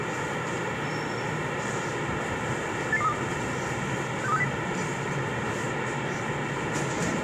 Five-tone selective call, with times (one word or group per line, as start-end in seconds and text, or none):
2.9-3.1 88232
4.2-4.4 62360